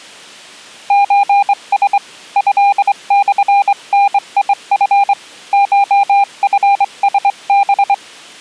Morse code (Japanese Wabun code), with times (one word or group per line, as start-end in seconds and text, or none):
0.9-2.0 ソラ
2.4-5.1 トモダチ
5.5-7.9 コチラハ